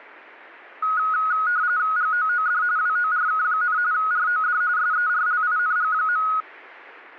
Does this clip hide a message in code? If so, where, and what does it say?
Yes: RTTY (45.45 baud, 170 Hz shift) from 0.8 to 6.4 s, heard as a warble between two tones, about 1360 Hz centre. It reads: GOOD WORK, ROD SERLING.